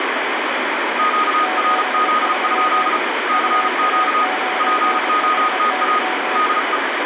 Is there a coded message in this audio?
Yes: Morse code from 0.9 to 6.8 s, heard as two keyed tones, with heavy radio static. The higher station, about 35 wpm, 1240 Hz: QRZ? CQ POTA DE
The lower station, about 25 wpm, 740 Hz: 73 UA9HY